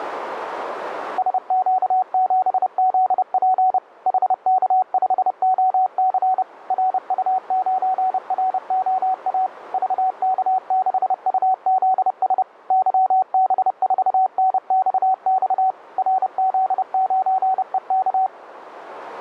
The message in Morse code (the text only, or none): SQ7ZP HK5OC RU9ROA VK6UZS YB4NXX RZ9EK